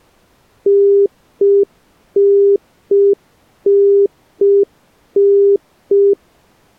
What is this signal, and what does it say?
Telephone call progress tone (UK plan), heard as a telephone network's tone, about 400 Hz. Congestion tone.